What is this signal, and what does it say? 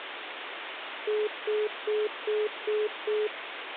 Telephone call progress tone (single-tone plan, as in most of Europe), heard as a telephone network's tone, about 420 Hz, 0.2 s on and 0.2 s off, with phone line noise. Congestion tone.